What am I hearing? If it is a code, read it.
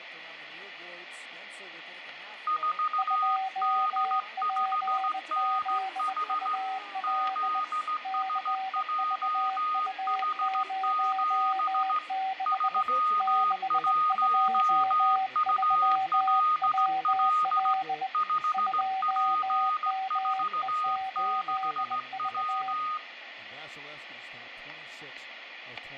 Morse code, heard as two keyed tones, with radio static and room echo. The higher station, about 16 wpm, 1240 Hz: 4D5NH ZSJH7 31ULL 5P46W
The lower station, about 20 wpm, 760 Hz: 2PZUL CVU06 623WL 2ME8V